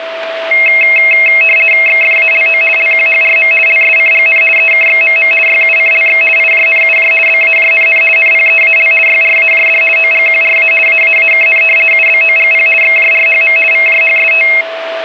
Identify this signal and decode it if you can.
RTTY (50 baud, 450 Hz shift), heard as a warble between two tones, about 2350 Hz centre, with radio static and a steady whistle near 660 Hz. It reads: XFALO LQHRM LSCGN EKXMM YUCLX IJNUJ BAJNN NPEAL YRAJD OGQRA AAAKN UBOGP XJRHM VJHST